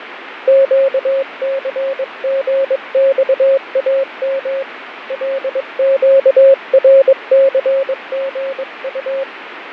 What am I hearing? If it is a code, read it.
Morse code, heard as a keyed tone, hand-sent with a paddle, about 22 wpm, 540 Hz, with radio static and fading. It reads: QCGXAM LQRCGU